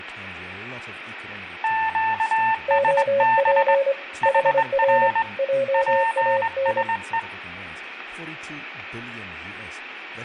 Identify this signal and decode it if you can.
Morse code, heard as two keyed tones, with radio static, room echo and speech in English. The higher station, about 21 wpm, 900 Hz: QSB HR PSE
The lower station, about 25 wpm, 550 Hz: OP HR JAN